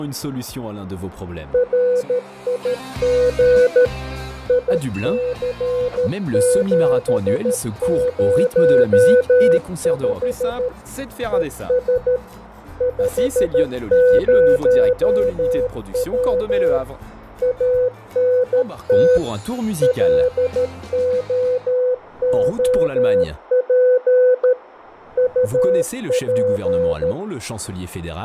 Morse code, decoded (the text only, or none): RIG IC705 ES 50W ANT LOOP UP